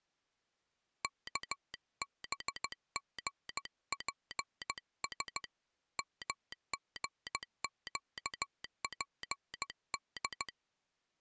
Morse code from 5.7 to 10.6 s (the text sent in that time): MGQPD